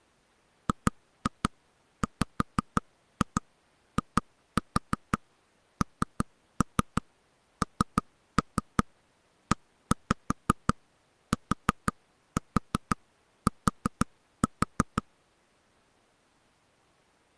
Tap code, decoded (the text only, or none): GWINNETT